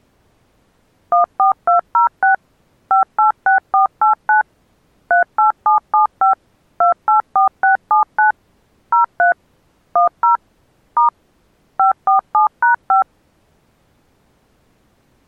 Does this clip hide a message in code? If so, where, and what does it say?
Yes: DTMF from 1.1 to 13.0 s, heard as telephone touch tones, dialled by machine, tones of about 120 ms. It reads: 14206 586489 38775 284679 03 10 * 547#5